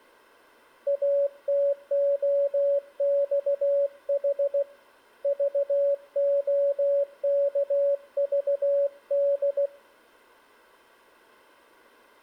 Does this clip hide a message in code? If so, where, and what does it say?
Yes: Morse code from 0.8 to 9.7 s, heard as a keyed tone, hand-sent with a paddle, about 16 wpm, 560 Hz. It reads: ATOXH VOKVD